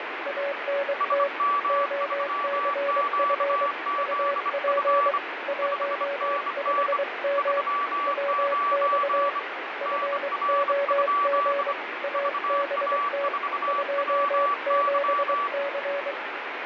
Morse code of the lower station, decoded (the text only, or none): ANT OCF UP 15M WX FOG ABT 27C